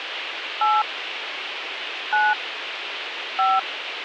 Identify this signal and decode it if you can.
DTMF, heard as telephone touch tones, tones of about 210 ms, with radio hiss. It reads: 8 9 5